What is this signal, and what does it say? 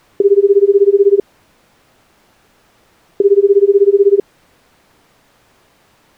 Telephone call progress tone (Japanese plan), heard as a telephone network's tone, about 380, 400, 420 Hz, 1 s on and 2 s off. Ringback tone.